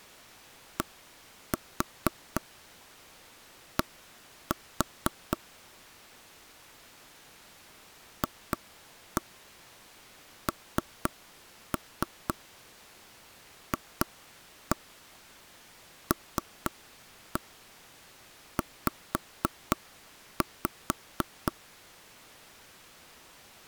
Tap code, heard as taps on a table, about 4 knocks a second. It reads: DD FNFLZ